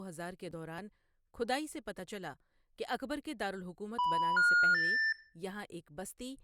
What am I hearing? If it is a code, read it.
Telephone call progress tone (North American plan), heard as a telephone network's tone, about 980, 1430, 1800 Hz, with room echo and speech in Urdu. Special information tone.